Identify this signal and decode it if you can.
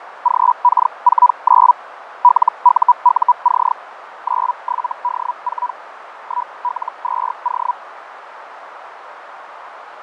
Hellschreiber (Feld-Hell, 122.5 baud), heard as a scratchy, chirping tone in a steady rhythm, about 980 Hz, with radio static, fading and a narrow filter. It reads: GK49 LUUC 97D4 1L2O